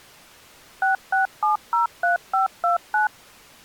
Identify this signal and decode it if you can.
DTMF, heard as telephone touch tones, dialled by machine, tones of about 130 ms. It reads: 66703529